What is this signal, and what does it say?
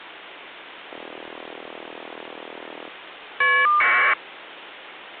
Caller ID data burst, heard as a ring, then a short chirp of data, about 1200 baud, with phone line noise.